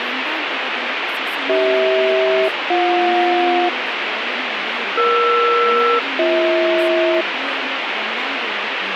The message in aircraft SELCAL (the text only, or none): CH-BJ ER-BH